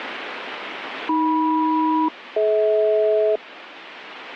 Aircraft SELCAL, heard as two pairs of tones, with radio static. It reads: AM-DH